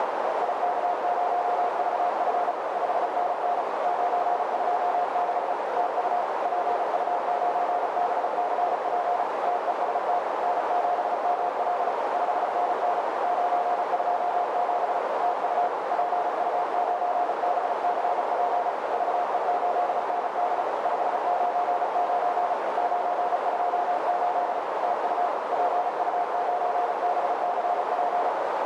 Morse code, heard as a keyed tone, machine-sent, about 35 wpm, 710 Hz, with heavy radio static and a narrow filter. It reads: IK0VF 5NN 926 TU PU9BCP TEST N7ML 5NN 927 TU PU9BCP VE8ND 599 928 TU PU9BCP